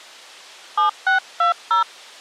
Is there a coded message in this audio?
Yes: DTMF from 0.8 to 1.8 s, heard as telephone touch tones, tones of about 120 ms. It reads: 7620